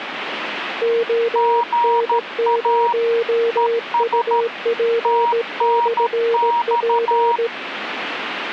Morse code, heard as two keyed tones, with radio static. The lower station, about 17 wpm, 460 Hz: ON0UP/P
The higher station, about 13 wpm, 950 Hz: GA ES TNX